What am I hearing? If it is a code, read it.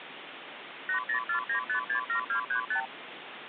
Multi-frequency trunk signalling (R2, with the far end's replies), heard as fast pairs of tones, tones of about 100 ms, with phone line noise. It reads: 8049567235